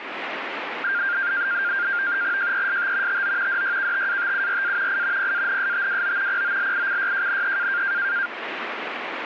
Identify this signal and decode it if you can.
NAVTEX (SITOR-B), 100 baud, 170 Hz shift, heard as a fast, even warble, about 1500 Hz centre, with radio static. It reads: JEST TO DYKTATURA I PANSTWO POLICYJNE